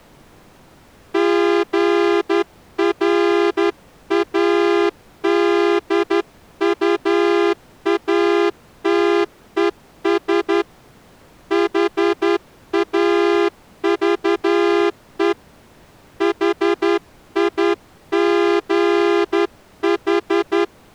Morse code, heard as a horn, hand-sent with a straight key, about 11 wpm. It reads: GRADUATES HAVE HIGH